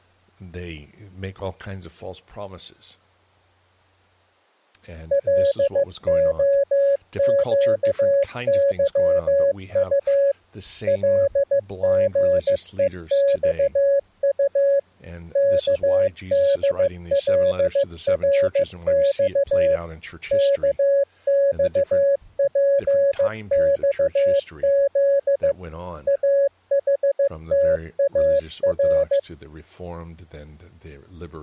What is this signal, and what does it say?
Morse code, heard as a keyed tone, machine-sent, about 15 wpm, 560 Hz, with speech in English. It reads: LOQYU LGEXU KDLRX KXPXZ AHTAR